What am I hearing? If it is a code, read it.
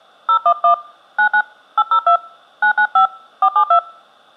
DTMF, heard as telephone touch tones, dialled by hand, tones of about 70 ms. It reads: 011 99 802 995 472